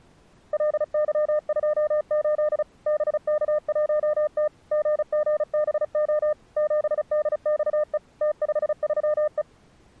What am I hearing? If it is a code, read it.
Morse code, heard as a keyed tone, machine-sent, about 35 wpm, 600 Hz. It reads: LY28 BK1T GGBO 7DXE T53E